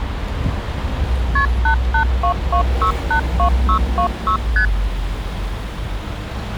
Multi-frequency trunk signalling (R1, as on North American trunks), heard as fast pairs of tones, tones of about 90 ms, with street noise. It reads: KP 8822682626 ST